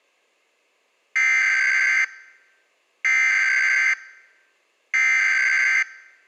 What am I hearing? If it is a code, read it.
Emergency Alert System (SAME) tones (header bursts), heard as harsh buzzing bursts, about 520.83 baud.